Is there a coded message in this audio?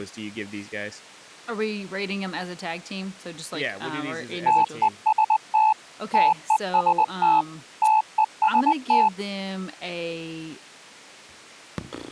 Yes: Morse code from 4.4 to 9.1 s, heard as a keyed tone, machine-sent, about 20 wpm, 870 Hz, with speech in English. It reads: TEST TEST TEST